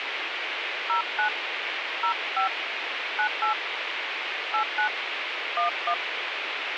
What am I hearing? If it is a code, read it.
DTMF, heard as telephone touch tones, dialled by hand, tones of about 100 ms, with phone line noise. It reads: 09 05 98 89 11